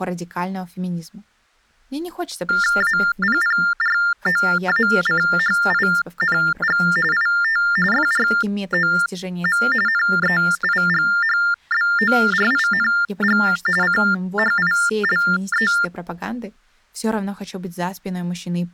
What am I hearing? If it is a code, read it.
TTY/TDD text telephone tones (45.45 baud Baudot), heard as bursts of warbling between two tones, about 400 Hz shift, 1600 Hz centre. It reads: APPROACHING IT FROM NEIGHBORING CHILE